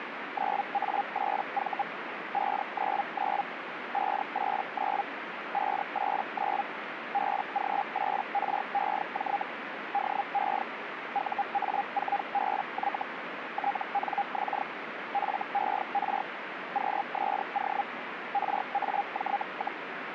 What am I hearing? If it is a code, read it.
Hellschreiber (Feld-Hell, 122.5 baud), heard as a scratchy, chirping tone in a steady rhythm, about 810 Hz, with radio static. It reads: 9A8V 599 589 589 BG8REJ DE UA4BY TNX FER QSO RAJ,